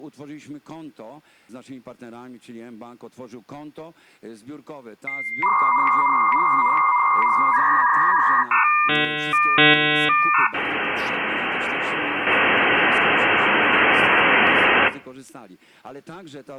Dial-up modem handshake (V.34 or later), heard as a whistle, warbles, then hiss, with room echo.